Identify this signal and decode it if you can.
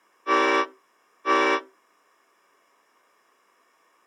Train horn signal, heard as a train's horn. 2 short. On North American railways: a signal is acknowledged.